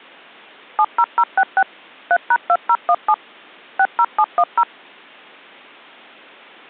DTMF, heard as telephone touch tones, dialled by machine, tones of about 60 ms. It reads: 70066 3#2017 60710